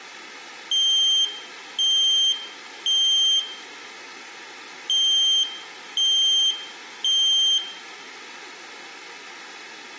Alarm pattern, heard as an alarm's beeps, played twice, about 3150 Hz, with room echo. Temporal three. Smoke or fire, evacuate.